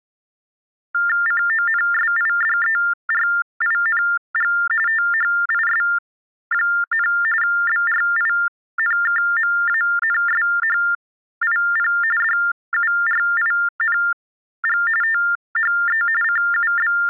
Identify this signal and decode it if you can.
TTY/TDD text telephone tones (45.45 baud Baudot), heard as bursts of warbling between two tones, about 400 Hz shift, 1600 Hz centre. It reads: CONSIDERING THIS, BRINKMANSHIP DURING THE …